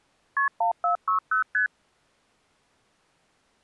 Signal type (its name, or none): multi-frequency trunk signalling